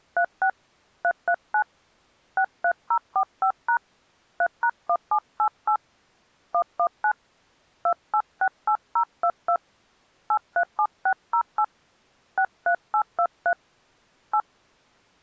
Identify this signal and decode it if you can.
DTMF, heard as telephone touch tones, dialled by hand, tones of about 80 ms. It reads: 36 339 63045# 3#1788 119 2868022 837608 63823 8